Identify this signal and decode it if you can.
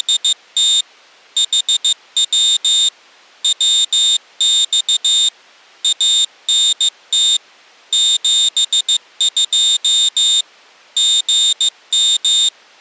Morse code, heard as a high beeper, machine-sent, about 15 wpm, 3650 Hz. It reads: … HW WX ANT 72 GM